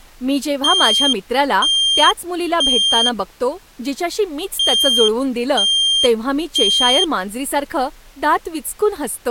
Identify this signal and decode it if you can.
Alarm pattern, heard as an alarm's beeps, played twice, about 3200 Hz, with speech in Marathi. Temporal three. Smoke or fire, evacuate.